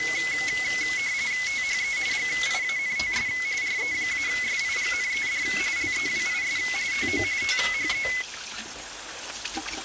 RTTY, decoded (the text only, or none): THE GIANTS RE-SIGNED LEWIS TO THE